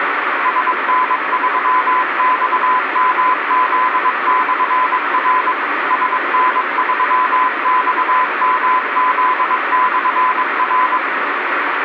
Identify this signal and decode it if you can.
Morse code, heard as a keyed tone, machine-sent, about 22 wpm, 1010 Hz, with radio static. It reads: SN3XMZ/R SN3XMZ/R